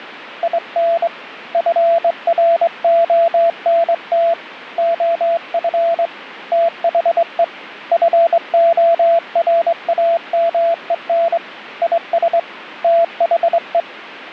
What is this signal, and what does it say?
Morse code, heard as a keyed tone, hand-sent with a straight key, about 22 wpm, 670 Hz, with radio static. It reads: IN FRONT OF THE FORAMEN IS THE